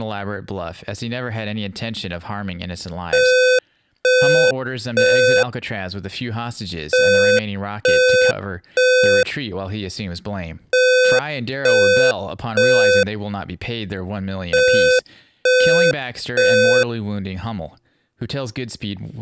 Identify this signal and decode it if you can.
Alarm pattern, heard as an alarm's beeps, played four times, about 510 Hz, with speech in English. Temporal three. Smoke or fire, evacuate.